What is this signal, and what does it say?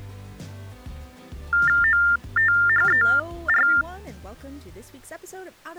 TTY/TDD text telephone tones (45.45 baud Baudot), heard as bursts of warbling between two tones, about 400 Hz shift, 1600 Hz centre. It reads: OTHER